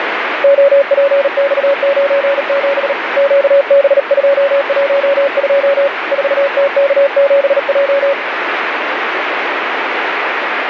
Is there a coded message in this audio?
Yes: Morse code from 0.4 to 8.2 s, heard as a keyed tone, hand-sent with a paddle, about 38 wpm, 560 Hz, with radio static. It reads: OPX97 QB212 4TK7J